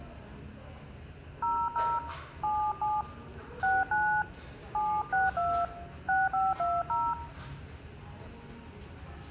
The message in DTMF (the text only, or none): 00 77 69 762 6520